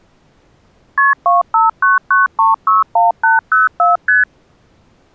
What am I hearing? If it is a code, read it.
Multi-frequency trunk signalling (R1, as on North American trunks), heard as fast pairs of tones, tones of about 160 ms. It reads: KP 2599361804 ST